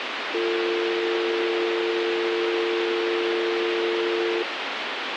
Telephone call progress tone (North American or UK plan), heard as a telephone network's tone, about 350, 450 Hz, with phone line noise. Dial tone.